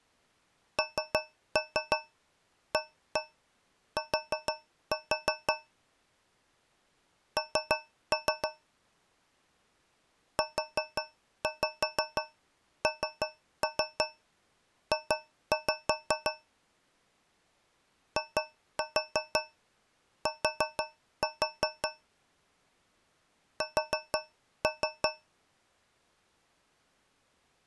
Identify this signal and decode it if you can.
Tap code, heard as taps on a metal pipe, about 6 knocks a second. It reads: NAT N UNJ IT S